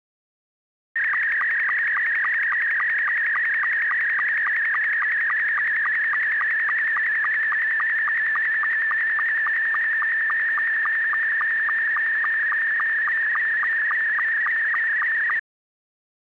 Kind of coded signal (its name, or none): SSTV (slow-scan television)